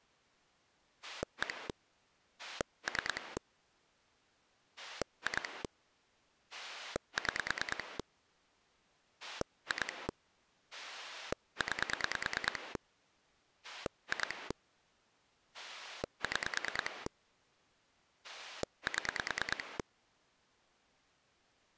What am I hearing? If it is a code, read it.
Pulse dialling, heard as a rotary dial, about 9 pulses a second. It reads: 1 3 2 6 2 9 2 6 7